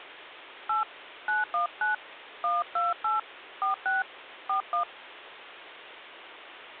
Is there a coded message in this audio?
Yes: DTMF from 0.7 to 4.8 s, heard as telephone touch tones, dialled by hand, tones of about 140 ms. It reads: 8 919 128 46 41